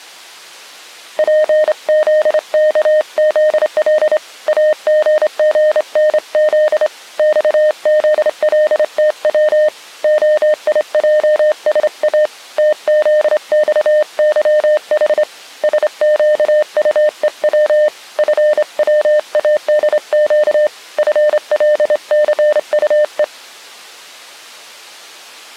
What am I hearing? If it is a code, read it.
Morse code, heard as a keyed tone, hand-sent with a straight key, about 27 wpm, 610 Hz. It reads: PZKZL AGGNZ XZLTW OIJSA TZXYH SQUEW FWADQ FLCUE